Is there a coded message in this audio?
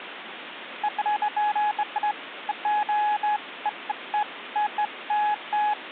No, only beeps of irregular length, with phone line noise.